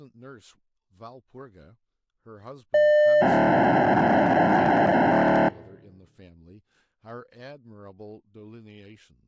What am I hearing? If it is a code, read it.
POCSAG pager data (1200 baud), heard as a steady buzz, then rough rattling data, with speech in English.